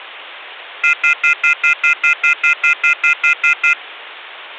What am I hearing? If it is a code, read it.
Telephone call progress tone (North American plan), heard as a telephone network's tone, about 1400, 2050, 2450, 2600 Hz, 0.1 s on and 0.1 s off. Off-hook warning tone.